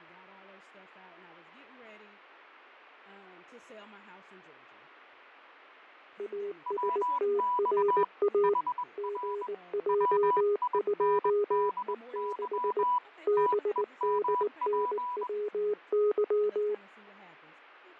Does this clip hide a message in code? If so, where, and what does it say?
Yes: Morse code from 6.1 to 16.8 s, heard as two keyed tones, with fading and speech in English. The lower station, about 19 wpm, 410 Hz: ASTRA GJ2E6 BDNWY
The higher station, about 21 wpm, 990 Hz: WX HR WINDY TEMP